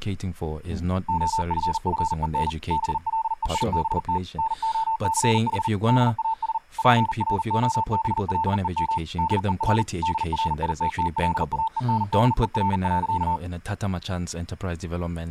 Morse code, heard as a keyed tone, machine-sent, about 40 wpm, 890 Hz, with speech in English. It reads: OFFEN BLEIBT NOCH DAS PROBLEM DER DRITTLAENDER.